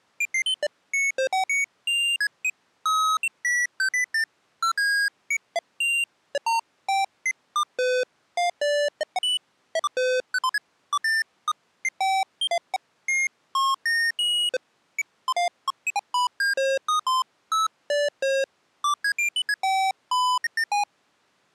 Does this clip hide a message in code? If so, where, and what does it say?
No, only electronic bleeps of random pitch and length.